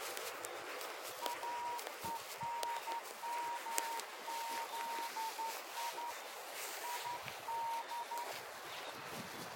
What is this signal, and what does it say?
Morse code, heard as a whistle, hand-sent with a straight key, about 12 wpm, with the noise of a residential street. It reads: AENMZI ID